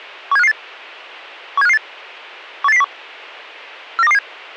Five-tone selective call (EEA), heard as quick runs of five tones, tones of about 40 ms. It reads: 17558 17558 18801 49227